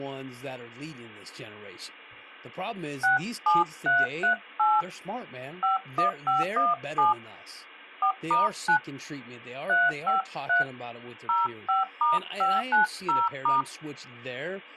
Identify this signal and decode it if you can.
DTMF, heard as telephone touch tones, dialled by hand, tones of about 150 ms, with speech in English. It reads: 67338 51517 4*9 353 05*590*